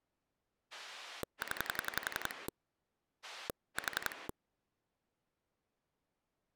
Pulse dialling, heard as a rotary dial, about 11 pulses a second. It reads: 0 4